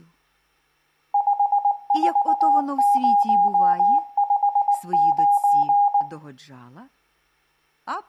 Morse code, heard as a keyed tone, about 19 wpm, 810 Hz, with room echo. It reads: 54059